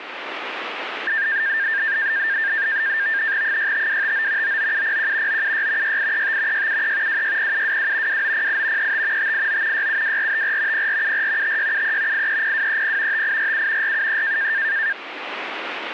NAVTEX (SITOR-B), 100 baud, 170 Hz shift, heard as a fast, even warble, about 1700 Hz centre, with radio static. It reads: 65259 99701 976 6835 673 260722 2908 35 589 672454 0474 5673 830230 5847 473